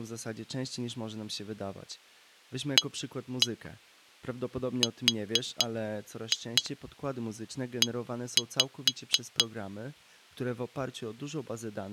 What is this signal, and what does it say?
Tap code, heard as taps on glass, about 4 knocks a second, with speech in Polish. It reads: ARE